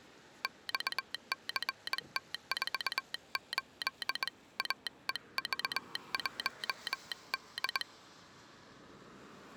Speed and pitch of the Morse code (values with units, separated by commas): 21 wpm